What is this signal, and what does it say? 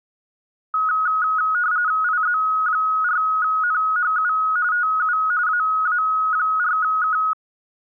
RTTY (45.45 baud, 170 Hz shift), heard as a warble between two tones, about 1360 Hz centre. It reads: IZ4NHU TU AA4K